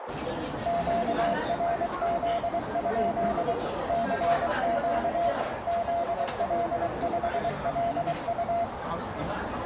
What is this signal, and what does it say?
Morse code, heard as a keyed tone, machine-sent, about 23 wpm, 690 Hz, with radio static, a narrow filter and the noise of a restaurant. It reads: QRZ? CQ ZL5LU